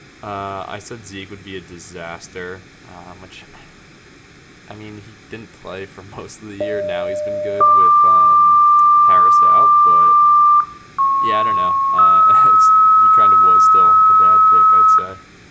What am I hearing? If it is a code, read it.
Two-tone page, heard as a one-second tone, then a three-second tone, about 600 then 1180 Hz, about 1090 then 1290 Hz, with room echo and speech in English.